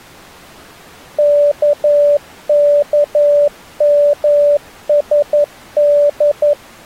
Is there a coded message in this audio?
Yes: Morse code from 1.1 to 6.6 s, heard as a keyed tone, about 11 wpm, 580 Hz. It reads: KKMSD